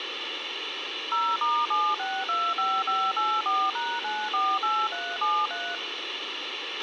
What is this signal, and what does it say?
DTMF, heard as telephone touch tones, dialled by machine, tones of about 240 ms, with radio hiss and a squelch burst at the end. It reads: 0*7625584#948373